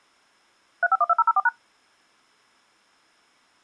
DTMF, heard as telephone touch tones, dialled by machine, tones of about 40 ms. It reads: 3512004#